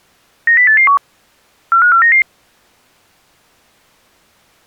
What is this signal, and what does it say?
Five-tone selective call (CCIR), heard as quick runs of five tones, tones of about 100 ms. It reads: 90881 45499